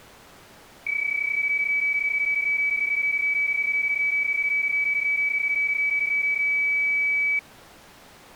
PSK31 (31.25 baud), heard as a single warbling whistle, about 2300 Hz.